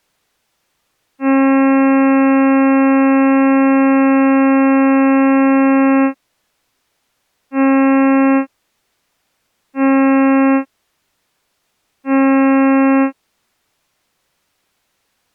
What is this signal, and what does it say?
Ship horn signal, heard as a ship's horn, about 270 Hz. 1 long, 3 short. At sea: a vessel under tow in fog.